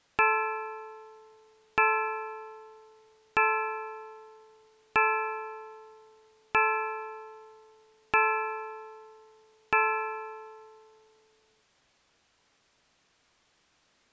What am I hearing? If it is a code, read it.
Clock strike, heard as a bell. 7. Seven o'clock.